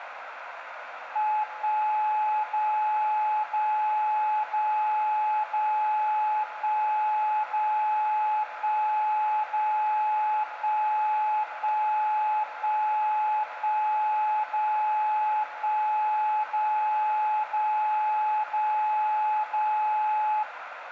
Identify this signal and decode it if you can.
Radio time signal (DCF77), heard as a tone whose level steps once a second, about 850 Hz, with radio static, a narrow filter and room echo. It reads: 1 0 0 0 0 1 0 1 0 1 1 1 1 0 1 0 0 0 0